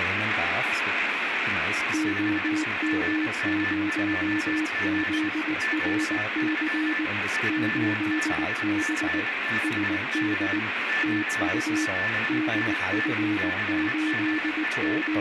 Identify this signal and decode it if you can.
Morse code, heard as a keyed tone, machine-sent, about 19 wpm, 310 Hz, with radio static, a weaker station near 1760 Hz and room echo. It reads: OM0ZRC 8B SD TU …